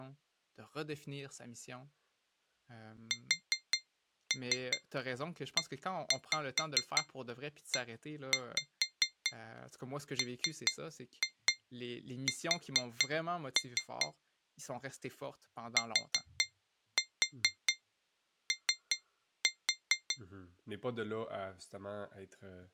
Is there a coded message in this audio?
Yes: tap code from 3.1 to 20.2 s, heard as taps on glass, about 4 knocks a second, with speech in French. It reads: SEEMS TO